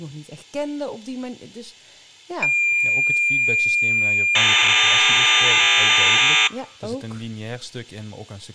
Cassette data (Kansas City type), 1200 baud, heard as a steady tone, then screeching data, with speech in Dutch.